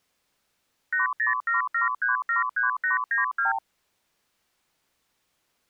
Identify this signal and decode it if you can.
Multi-frequency trunk signalling (R2, with the far end's replies), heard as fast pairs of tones, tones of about 140 ms. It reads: 8077373892